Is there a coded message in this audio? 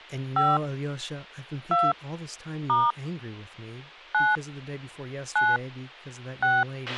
Yes: DTMF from 0.4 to 6.6 s, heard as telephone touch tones, dialled by hand, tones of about 210 ms, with a squelch burst at the end and speech in English. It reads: 5 2 * 9 9 6